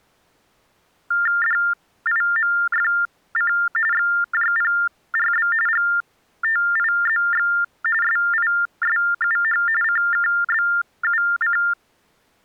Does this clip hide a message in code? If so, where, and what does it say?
Yes: TTY/TDD text telephone tones (45.45 baud Baudot) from 1.1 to 11.7 s, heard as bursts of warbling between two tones, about 400 Hz shift, 1600 Hz centre. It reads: DIMFC XJPRB GTIZX SISUH CKBUC